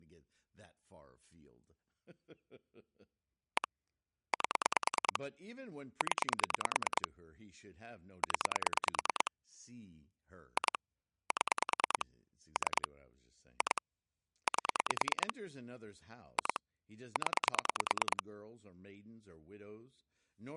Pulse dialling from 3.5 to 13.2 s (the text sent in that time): 1 8 0 0 2 7 3